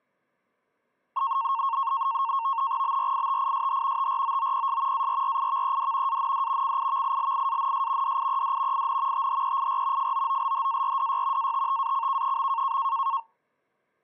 NAVTEX (SITOR-B), 100 baud, 170 Hz shift, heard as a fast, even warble, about 1000 Hz centre. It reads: BRITISH TROOPS ARRIVED AND CIVILIANS DIED IN THEIR FOOLHARDY ATTACK.